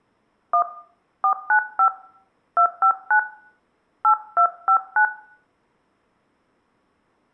DTMF, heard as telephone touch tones, dialled by hand, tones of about 90 ms, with room echo. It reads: 1 495 259 8259